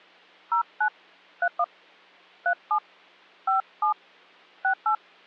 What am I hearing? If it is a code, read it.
DTMF, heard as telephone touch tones, dialled by hand, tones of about 90 ms. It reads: 09 31 37 57 68